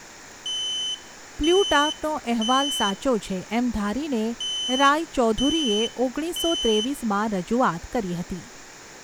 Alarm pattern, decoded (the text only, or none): temporal three